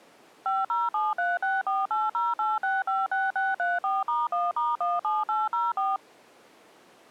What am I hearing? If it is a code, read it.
DTMF, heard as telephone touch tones, dialled by machine, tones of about 190 ms. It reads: 507364808656634*1*17804